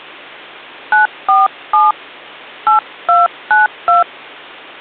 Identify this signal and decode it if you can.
DTMF, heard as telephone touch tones, dialled by hand, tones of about 150 ms, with hum. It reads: 947 8292